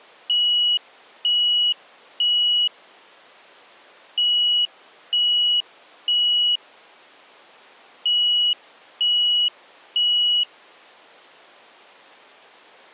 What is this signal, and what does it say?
Alarm pattern, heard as an alarm's beeps, played three times, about 2900 Hz. Temporal three. Smoke or fire, evacuate.